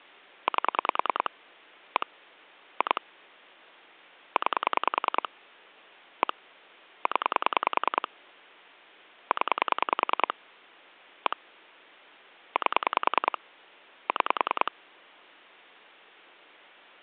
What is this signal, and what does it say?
Pulse dialling, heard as clicks on a phone line, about 10 pulses a second. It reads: 8 1 2 9 1 0 0 1 8 6